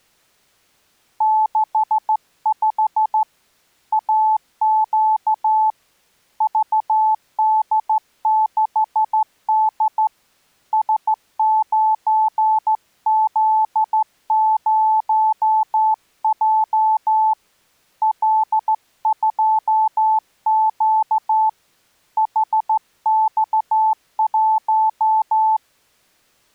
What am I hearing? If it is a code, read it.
Morse code, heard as a keyed tone, hand-sent with a straight key, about 14 wpm, 870 Hz. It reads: 65 AQ VD6D S9Z0J L2Q HX1